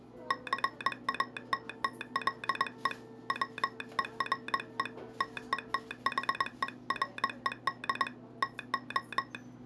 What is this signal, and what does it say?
Morse code, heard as a telegraph sounder, hand-sent with a paddle, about 21 wpm, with the noise of a cafe. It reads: CATTLE WERE TETHERED TO